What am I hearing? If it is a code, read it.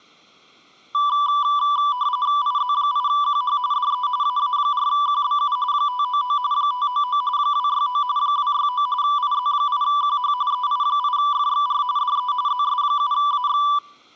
RTTY (45.45 baud, 170 Hz shift), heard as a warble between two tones, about 1080 Hz centre. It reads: IZ8QH DE AA4QBU 599 599 269 269 IZ8QH EI8FXR DE ZS7AX